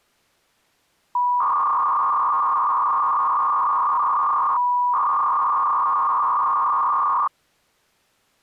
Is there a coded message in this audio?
Yes: 300-baud modem data (V.21 tones) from 1.2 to 7.3 s, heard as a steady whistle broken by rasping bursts, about 300 baud, 200 Hz shift.